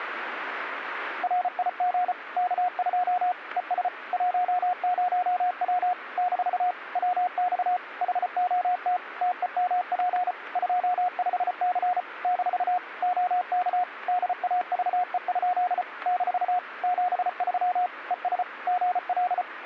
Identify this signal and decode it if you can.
Morse code, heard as a keyed tone, machine-sent, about 34 wpm, 720 Hz. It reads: RIG K2 ES 10W - WX HOT TEMP 25C - OK DAVE? - 73 ES GL